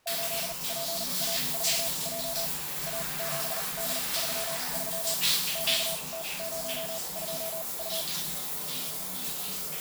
Morse code, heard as a keyed tone, machine-sent, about 39 wpm, spaced as for 29 wpm, 660 Hz, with the noise of a restroom. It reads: 8PA4J A7D33 QT02U